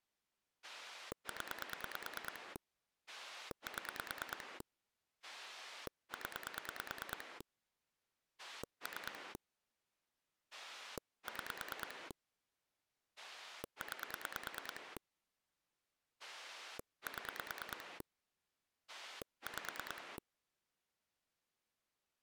Pulse dialling, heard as a rotary dial, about 9 pulses a second. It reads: 0 7 0 3 6 9 7 5